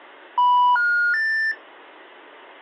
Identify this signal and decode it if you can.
Telephone call progress tone (North American plan), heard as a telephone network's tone, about 980, 1430, 1800 Hz. Special information tone.